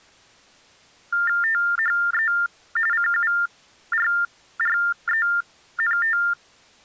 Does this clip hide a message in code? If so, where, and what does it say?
Yes: TTY/TDD text telephone tones (45.45 baud Baudot) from 1.1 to 6.3 s, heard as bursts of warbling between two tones, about 400 Hz shift, 1600 Hz centre. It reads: THE CURRENT